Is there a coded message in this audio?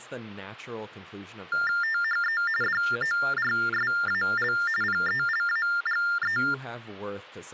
Yes: TTY/TDD text telephone tones (45.45 baud Baudot) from 1.5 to 6.5 s, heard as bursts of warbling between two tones, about 400 Hz shift, 1600 Hz centre, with speech in English. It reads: THE DORSAL PELAGE